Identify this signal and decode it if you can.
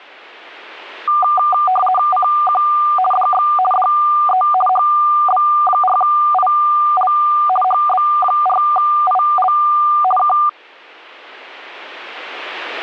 RTTY (50 baud, 450 Hz shift), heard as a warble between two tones, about 970 Hz centre. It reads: CQ DX DE HB4IL HB4IL K